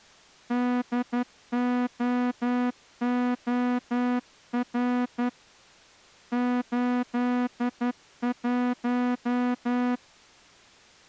Morse code, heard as a horn, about 11 wpm. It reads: DOOR 81